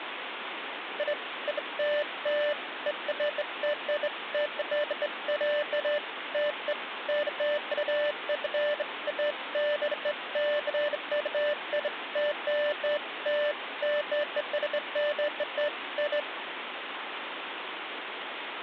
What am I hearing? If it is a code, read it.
Beeps of irregular length, with phone line noise. There is no code.